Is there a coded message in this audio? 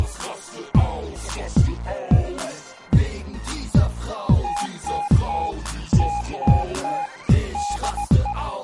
Yes: Morse code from 4.4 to 8.4 s, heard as a keyed tone, machine-sent, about 17 wpm, 820 Hz. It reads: TTT TTT DE